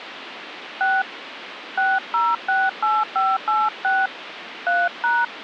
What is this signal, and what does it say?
DTMF, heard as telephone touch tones, dialled by hand, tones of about 210 ms, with phone line noise. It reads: 6 6068586 3#